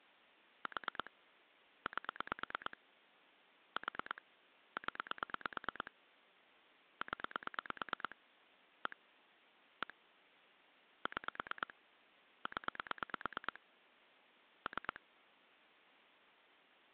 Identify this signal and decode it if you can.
Pulse dialling, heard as clicks on a phone line, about 9 pulses a second. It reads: 4 8 4 0 0 1 1 6 0 3